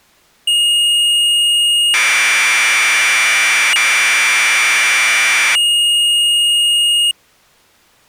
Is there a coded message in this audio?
Yes: Commodore tape loading (standard loader) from 0.5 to 7.1 s, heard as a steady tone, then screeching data.